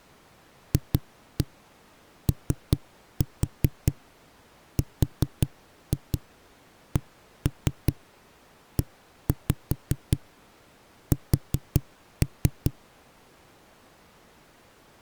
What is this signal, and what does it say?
Tap code, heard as knocks on a wall, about 5 knocks a second. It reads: FORCES